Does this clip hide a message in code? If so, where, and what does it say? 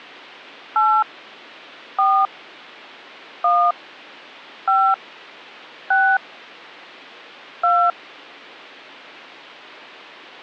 Yes: DTMF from 0.8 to 7.9 s, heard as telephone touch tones, dialled by hand, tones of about 270 ms. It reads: 8 4 1 5 6 2